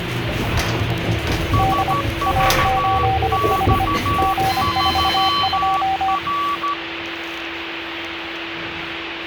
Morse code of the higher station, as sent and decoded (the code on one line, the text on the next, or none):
... ...- -..- ...-- .-.
SVX3R